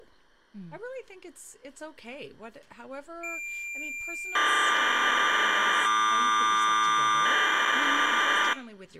Cassette data (Kansas City type), 1200 baud, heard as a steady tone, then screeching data, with speech in English.